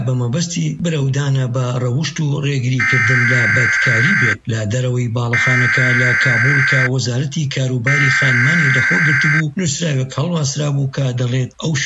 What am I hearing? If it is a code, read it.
Emergency Alert System (SAME) tones (header bursts), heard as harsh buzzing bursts, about 520.83 baud.